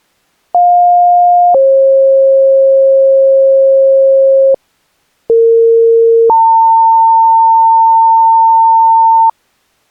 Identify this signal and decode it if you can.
Two-tone page, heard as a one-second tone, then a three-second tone, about 710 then 540 Hz, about 460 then 900 Hz.